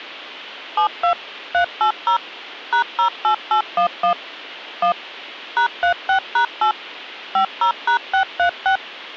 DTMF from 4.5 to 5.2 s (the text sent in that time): 1